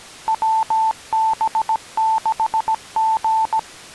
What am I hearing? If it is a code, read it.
Morse code, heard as a keyed tone, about 17 wpm, 880 Hz. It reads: WB6G